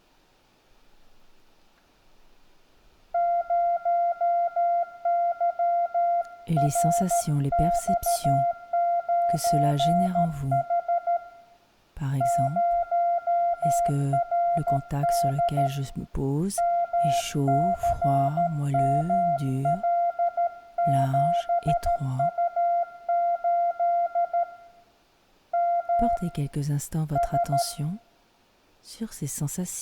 Morse code, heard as a keyed tone, hand-sent with a paddle, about 13 wpm, 690 Hz, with room echo. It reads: 0YRX9H 0RD MCML7U8 M S